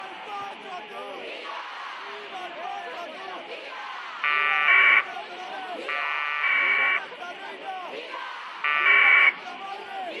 Packet radio (AX.25, as in APRS), 1200 baud, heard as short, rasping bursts.